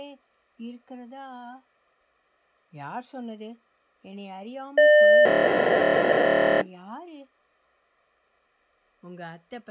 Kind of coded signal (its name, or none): POCSAG pager data